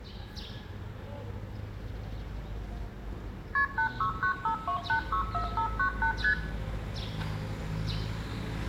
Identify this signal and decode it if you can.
Multi-frequency trunk signalling (R1, as on North American trunks), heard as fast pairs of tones, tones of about 100 ms, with room echo and the noise of a residential street. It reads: KP 86952864598 ST